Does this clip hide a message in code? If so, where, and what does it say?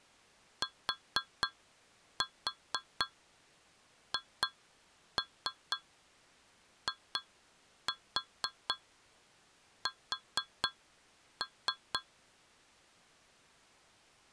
Yes: tap code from 0.6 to 12.1 s, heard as taps on a metal pipe, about 4 knocks a second. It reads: THIS